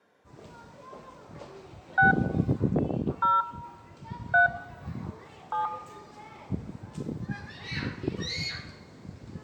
DTMF, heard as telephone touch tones, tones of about 140 ms, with room echo and the noise of a park. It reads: 6 0 3 7